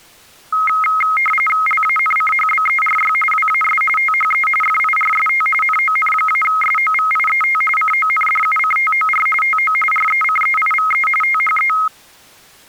RTTY (45.45 baud, 850 Hz shift), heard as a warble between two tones, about 1700 Hz centre. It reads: LANCHBERY WAS THE FIRST NON-SOVIET CONDUCTOR TO RECEIVE THE